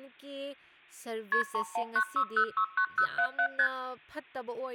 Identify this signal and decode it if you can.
Multi-frequency trunk signalling (R1, as on North American trunks), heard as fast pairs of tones, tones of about 80 ms, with hum and speech in Manipuri. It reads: KP 3196069077 ST